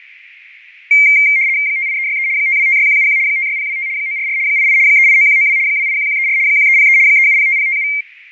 RTTY (75 baud, 170 Hz shift), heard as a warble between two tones, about 2200 Hz centre, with radio static and fading. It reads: 58363 5256171 56025 944 88 389192 281134 1303 3705057